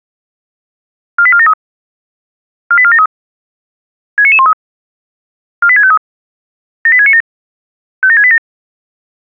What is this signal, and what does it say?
Five-tone selective call (ZVEI), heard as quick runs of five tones, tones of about 70 ms. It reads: 48473 48473 69913 48653 78697 57687